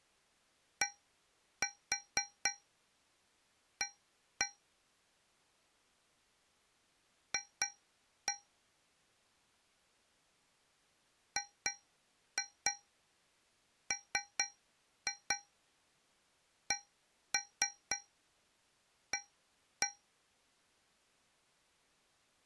Tap code, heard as taps on a metal pipe, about 4 knocks a second. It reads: DA F GMCA